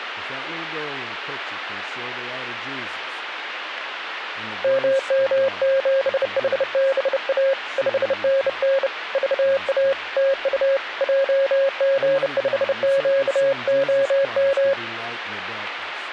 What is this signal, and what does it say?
Morse code, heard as a keyed tone, hand-sent with a bug key, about 30 wpm, 540 Hz, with speech in English. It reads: MM7HBA 5NN VA TU JG5QOM